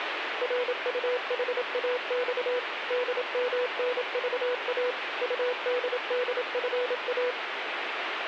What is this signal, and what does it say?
Morse code, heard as a keyed tone, machine-sent, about 27 wpm, 500 Hz, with radio static. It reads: RUHAX DMNVA UDDFA